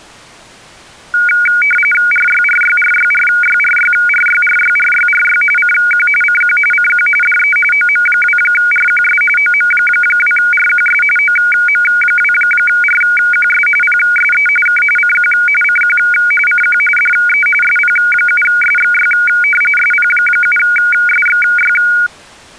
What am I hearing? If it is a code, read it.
RTTY (45.45 baud, 850 Hz shift), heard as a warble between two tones, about 1850 Hz centre. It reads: RYRYRYRYRYRYRYRYRY CQ CQ CQ DE OM2RQS OM2RQS OM2RQS PSE K CQ CQ CQ DE SP7SXY SP7SXY